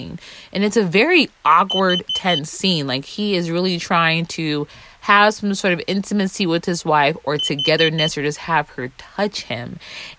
Alarm pattern, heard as an alarm's beeps, played twice, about 3050 Hz, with speech in English. Temporal four. Carbon monoxide.